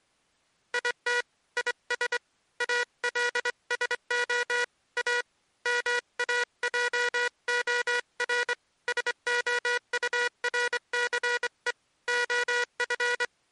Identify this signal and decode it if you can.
Morse code, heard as a buzzer, hand-sent with a straight key, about 24 wpm. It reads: IT IS ALSO A MAJOR SOURCE OF